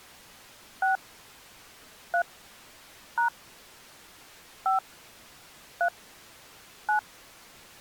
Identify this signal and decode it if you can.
DTMF, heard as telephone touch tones, dialled by hand, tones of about 100 ms. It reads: 6 3 # 5 3 9